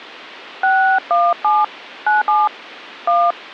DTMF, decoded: 617 97 1

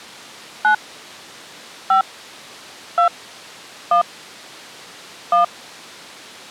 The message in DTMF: 9 5 2 1 1

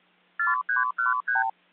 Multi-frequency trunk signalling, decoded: 4313

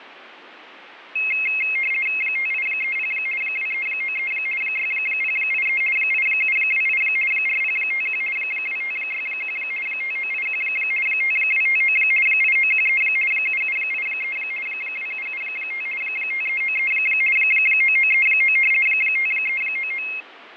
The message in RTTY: 5830 2393 6083 8728 4051 2561 5981 5259 8913 7783 2775 5393 9939 5399

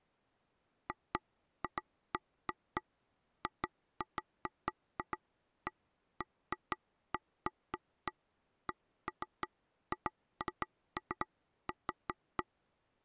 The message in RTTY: none

